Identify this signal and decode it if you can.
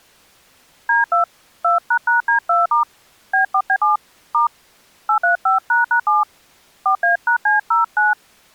DTMF, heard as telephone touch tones, dialled by hand, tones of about 120 ms. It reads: D2 2##D2* B4B7 * 835##7 4A#C09